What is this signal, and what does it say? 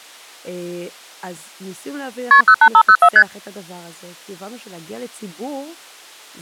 Multi-frequency trunk signalling (R1, as on North American trunks), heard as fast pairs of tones, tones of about 70 ms, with speech in Hebrew. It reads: KP 08504 ST